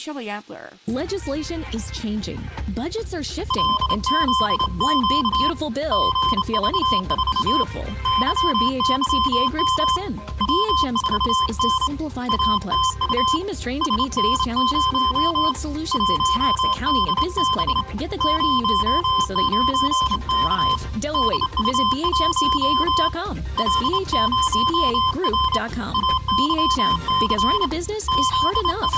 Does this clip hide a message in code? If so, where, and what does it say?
Yes: Morse code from 3.4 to 29.0 s, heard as a keyed tone, hand-sent with a straight key, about 27 wpm, 1040 Hz, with room echo. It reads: LZQ GV4 YYM W4N ATU SN0 1DB 09K DU1 L0R AYC …